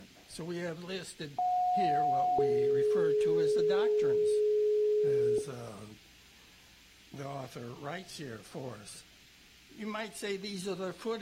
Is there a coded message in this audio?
Yes: two-tone page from 1.4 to 5.4 s, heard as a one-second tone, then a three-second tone, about 730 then 420 Hz.